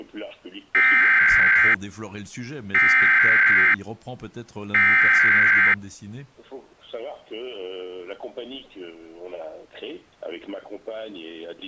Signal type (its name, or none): Emergency Alert System (SAME) tones